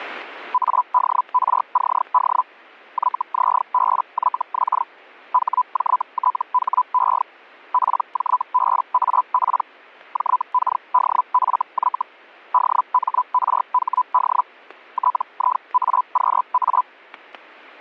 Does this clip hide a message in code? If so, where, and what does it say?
Yes: Hellschreiber (Feld-Hell, 122.5 baud) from 0.5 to 16.8 s, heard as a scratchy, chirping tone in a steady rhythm, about 1000 Hz, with static crashes. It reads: ADRCD YZBYX HJTHE PJBAP JKDFY DMRHD TIAQA